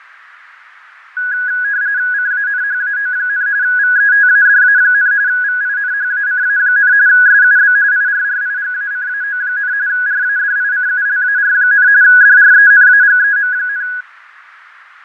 RTTY (45.45 baud, 170 Hz shift), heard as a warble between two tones, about 1550 Hz centre, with radio static and fading. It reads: CANHAO, VETADA, VINHACA, SUB IRRIGACAO, RADICULAR, DRENAGEM,